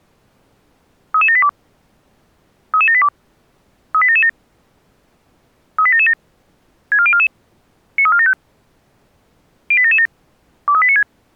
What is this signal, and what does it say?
Five-tone selective call (ZVEI), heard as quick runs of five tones, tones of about 70 ms. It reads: 33782 33782 38777 38777 64044 93475 08777 23896